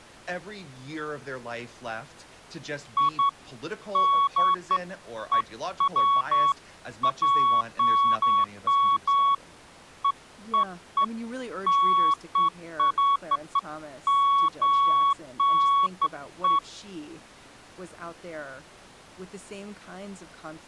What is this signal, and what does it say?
Beeps of irregular length, with speech in English. There is no code.